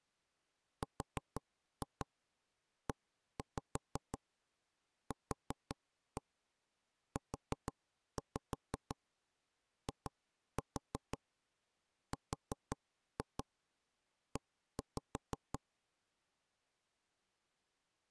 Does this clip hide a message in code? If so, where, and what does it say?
Yes: tap code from 0.8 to 15.6 s, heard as knocks on wood, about 5 knocks a second. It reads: REQUIRE